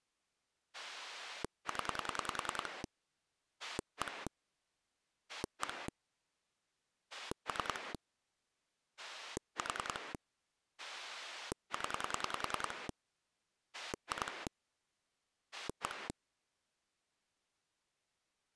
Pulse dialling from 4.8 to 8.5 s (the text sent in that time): 1 3